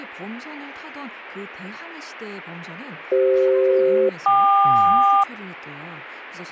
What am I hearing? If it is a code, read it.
Aircraft SELCAL, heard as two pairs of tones, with speech in Korean. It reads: CF-KQ